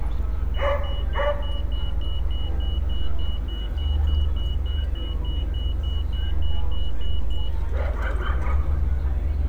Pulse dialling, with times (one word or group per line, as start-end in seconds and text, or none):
none